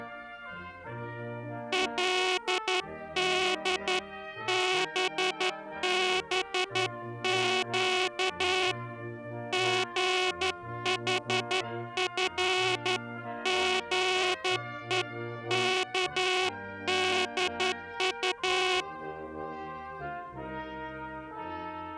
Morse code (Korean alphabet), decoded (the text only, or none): 그때 순사의